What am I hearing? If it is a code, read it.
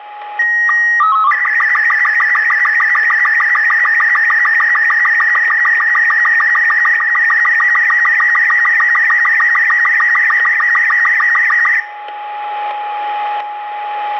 SSTV (slow-scan television), Robot 36, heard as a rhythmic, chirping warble, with static crashes, a steady whistle near 830 Hz and room echo.